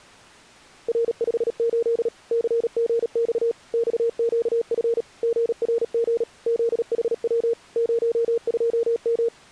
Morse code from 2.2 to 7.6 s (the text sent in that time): CGX XQF GRG ZHW